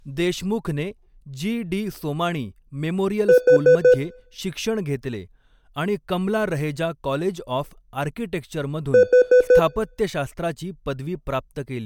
Alarm pattern, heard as an alarm's beeps, played twice, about 500 Hz, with room echo and speech in Marathi. Temporal four. Carbon monoxide.